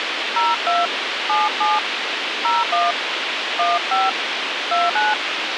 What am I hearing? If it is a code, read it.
DTMF, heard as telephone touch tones, dialled by hand, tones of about 190 ms, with radio hiss. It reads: 02 77 01 15 29